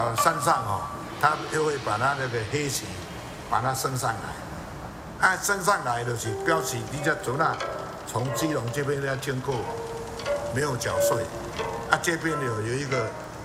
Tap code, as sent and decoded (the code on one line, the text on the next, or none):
none